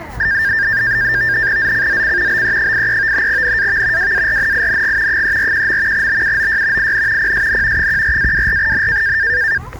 NAVTEX (SITOR-B), 100 baud, 170 Hz shift, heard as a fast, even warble, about 1700 Hz centre, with street noise. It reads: ZCZC BE83 NAV WARNING 341. BUOY IN PSN 14-24N